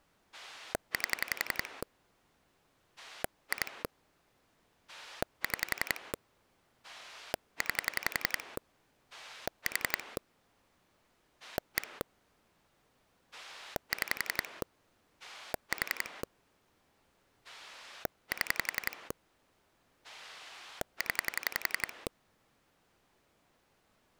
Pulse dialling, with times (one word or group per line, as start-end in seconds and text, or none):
0.3-1.8 8
3.0-3.8 2
4.9-6.1 6
6.8-8.6 9
9.1-10.2 4
11.4-12.0 1
13.3-14.6 6
15.2-16.2 4
17.4-19.1 7
20.0-22.1 0